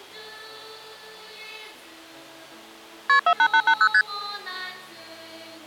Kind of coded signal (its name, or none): multi-frequency trunk signalling